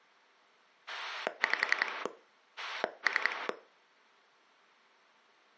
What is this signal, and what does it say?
Pulse dialling, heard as a rotary dial, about 11 pulses a second, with room echo. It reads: 5 3